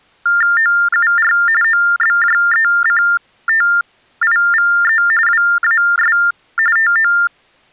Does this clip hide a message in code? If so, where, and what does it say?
Yes: TTY/TDD text telephone tones (45.45 baud Baudot) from 0.3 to 7.3 s, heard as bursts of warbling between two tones, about 400 Hz shift, 1600 Hz centre. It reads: OUR OBJECTIVE WAS TO